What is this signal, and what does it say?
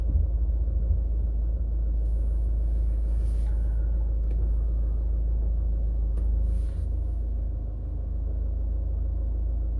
The noise inside a car. There is no code.